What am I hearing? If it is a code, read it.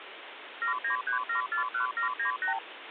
Multi-frequency trunk signalling (R2, with the far end's replies), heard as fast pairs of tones, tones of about 110 ms, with phone line noise. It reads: 793741798